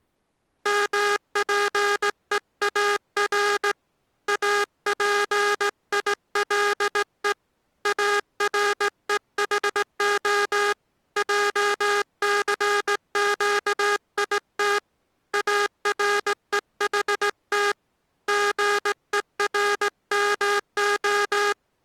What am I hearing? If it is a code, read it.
Morse code (Hebrew alphabet), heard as a buzzer, hand-sent with a straight key, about 17 wpm. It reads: מפואר אפילו ארוחה עסקית ארוחת גורמה